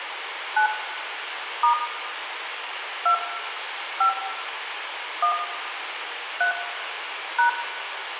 DTMF, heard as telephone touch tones, dialled by hand, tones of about 100 ms, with radio hiss and room echo. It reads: 9 * 2 5 1 3 #